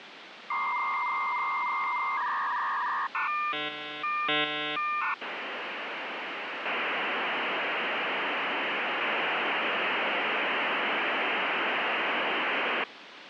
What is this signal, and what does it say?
Dial-up modem handshake (V.34 or later), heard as a whistle, warbles, then hiss, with phone line noise.